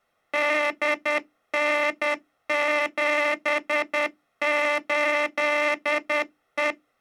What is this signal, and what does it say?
Morse code, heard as a buzzer, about 10 wpm. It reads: DN78E